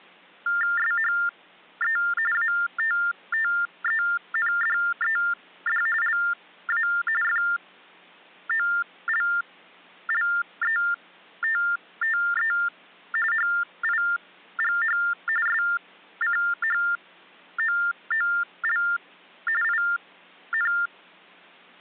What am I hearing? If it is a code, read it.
TTY/TDD text telephone tones (45.45 baud Baudot), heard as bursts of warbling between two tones, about 400 Hz shift, 1600 Hz centre. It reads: SHE ATTENDED LA FOLLETTE HIGH SCHOOL IN